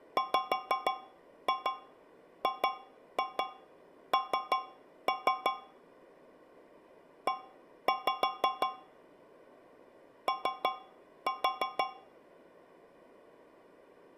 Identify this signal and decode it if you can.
Tap code, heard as taps on a metal pipe, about 5 knocks a second. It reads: WGN E O